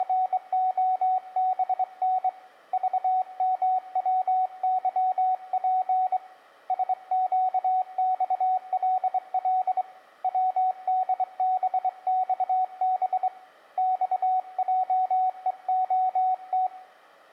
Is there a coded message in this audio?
Yes: Morse code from 0.0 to 16.7 s, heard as a keyed tone, hand-sent with a straight key, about 23 wpm, 750 Hz, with room echo. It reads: … VMWYP SQXLL WDBXB XJEOT